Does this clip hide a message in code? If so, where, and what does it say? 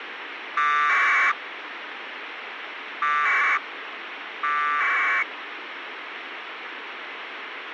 Yes: packet radio (AX.25, as in APRS), 1200 baud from 0.6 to 5.2 s, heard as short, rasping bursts, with radio hiss.